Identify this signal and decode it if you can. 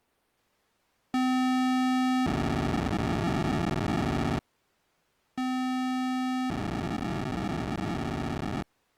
POCSAG pager data (512 baud), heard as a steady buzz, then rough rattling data.